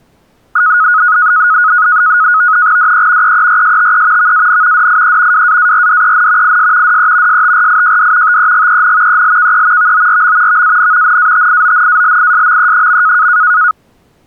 NAVTEX (SITOR-B), 100 baud, 170 Hz shift, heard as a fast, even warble, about 1360 Hz centre. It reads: DE EERSTE VAN DIE WAARDEN IS DE STRIJD TEGEN ELKE VORM VAN NATIONALISME.